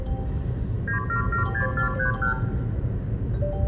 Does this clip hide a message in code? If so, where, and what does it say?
Yes: multi-frequency trunk signalling (R2, with the far end's replies) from 0.9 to 2.4 s, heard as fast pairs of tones, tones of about 110 ms, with room echo and the noise inside a car. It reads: 9776431